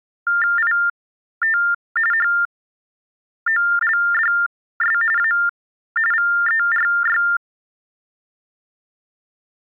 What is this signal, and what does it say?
TTY/TDD text telephone tones (45.45 baud Baudot), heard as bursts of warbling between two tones, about 400 Hz shift, 1600 Hz centre. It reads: IT HOLDS A VERY